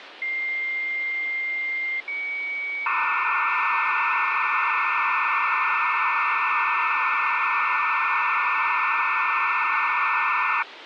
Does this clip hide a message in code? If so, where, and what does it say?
Yes: dial-up modem handshake (low-speed, two carriers) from 0.2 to 10.6 s, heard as two whistles, then hiss, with phone line noise.